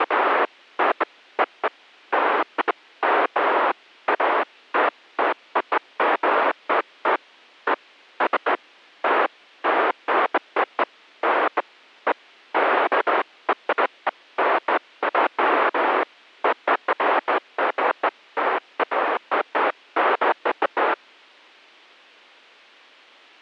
Bursts of noise. There is no code.